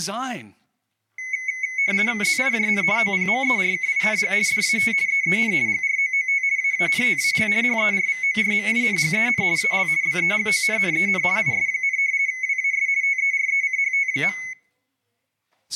RTTY (50 baud, 170 Hz shift), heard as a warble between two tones, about 2100 Hz centre, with room echo and speech in English. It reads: ZIJN OPMERKING DAT EEN GROOT AANTAL HERVORMINGEN AL BEGONNEN IS, WAS TERECHT.